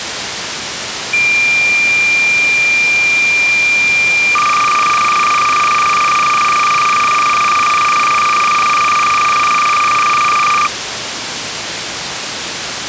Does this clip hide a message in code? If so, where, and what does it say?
Yes: cassette data (Kansas City type), 300 baud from 1.1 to 10.7 s, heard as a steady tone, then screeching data, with tape hiss.